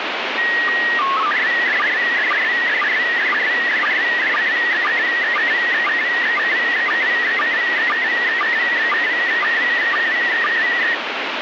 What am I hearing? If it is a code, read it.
SSTV (slow-scan television), PD 120, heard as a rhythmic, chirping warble, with radio static.